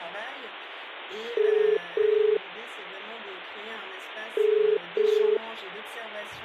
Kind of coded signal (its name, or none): telephone call progress tone